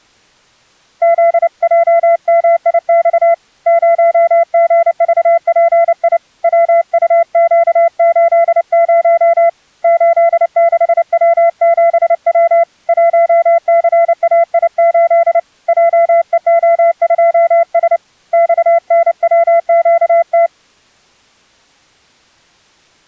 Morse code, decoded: ZJMIX 0GVPI WUQ80 86W7W 1CAI8 JEO2S XNWQT

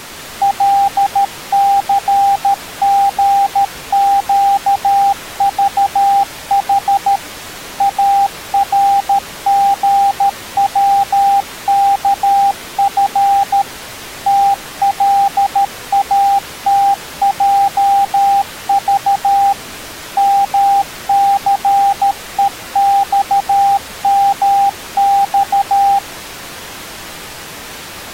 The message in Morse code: LCGQVH ARGWKF TLATJV MCEXMX

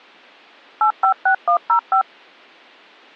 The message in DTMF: 856105

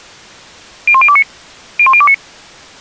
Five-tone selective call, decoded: 01029 01029

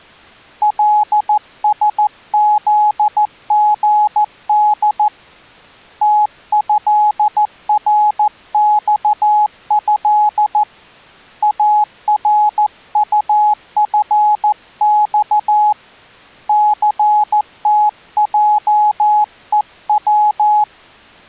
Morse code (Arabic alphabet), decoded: لسذغد تهرصه ارطفص ثتجءو

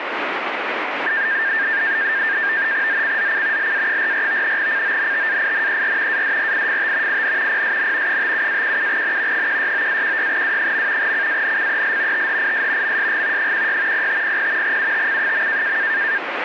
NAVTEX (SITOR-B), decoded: ZCZC LA44 CONTAINER ADRIFT IN PSN 57-17N 169-16W. CANCEL THIS MSG 16 0500 UTC.

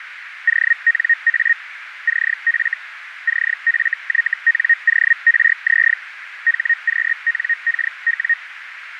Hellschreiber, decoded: ONA CF CFYNORZ HQNKW

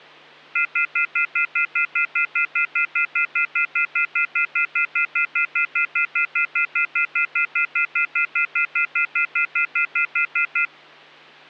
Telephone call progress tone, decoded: off-hook warning tone

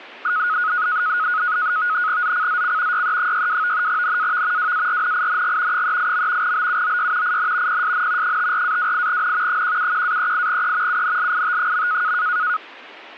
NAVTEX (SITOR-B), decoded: ZCZC YE62 NAV WARNING 38. BUOY IN PSN 54-28N 171-38E UNLIT.

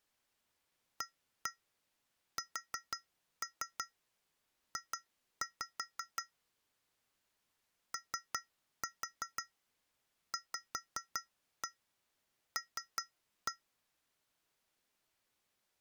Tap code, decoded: ASJ OVL

